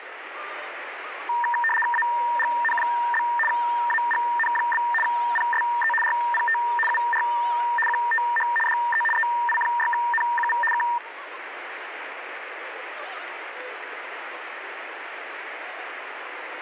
RTTY (75 baud, 850 Hz shift), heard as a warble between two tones, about 1380 Hz centre, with radio static. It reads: AGN? AGN? PSE RPT UR QTH DE EI6NQV K